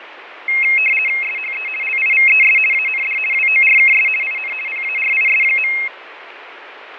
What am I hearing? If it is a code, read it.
RTTY (50 baud, 450 Hz shift), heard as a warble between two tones, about 2350 Hz centre, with radio static and fading. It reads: SHE LIVES AND WORKS IN PARIS.